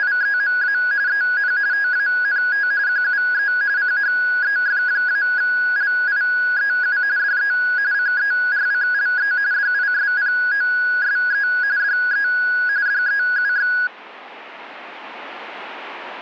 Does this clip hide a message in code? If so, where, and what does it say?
Yes: RTTY (45.45 baud, 170 Hz shift) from 0.0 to 13.9 s, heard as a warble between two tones, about 1550 Hz centre. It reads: … EN TANT QUE CHEF-LIEU DE CERCLE DISPOSE DE DEUX